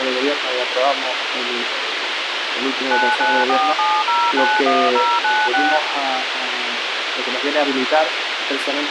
DTMF, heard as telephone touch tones, dialled by machine, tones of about 240 ms, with radio hiss. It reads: 9947091096